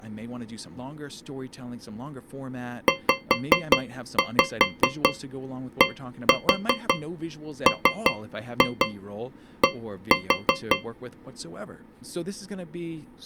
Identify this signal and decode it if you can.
Tap code, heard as taps on a metal pipe, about 5 knocks a second, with speech in English. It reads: ZDMD